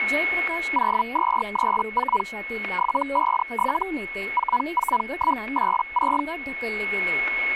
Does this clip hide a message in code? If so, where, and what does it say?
Yes: Hellschreiber (Feld-Hell, 122.5 baud) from 0.7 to 6.2 s, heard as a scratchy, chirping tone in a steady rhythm, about 980 Hz, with static crashes, a steady whistle near 2190 Hz and speech in Marathi. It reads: 0234 757 44186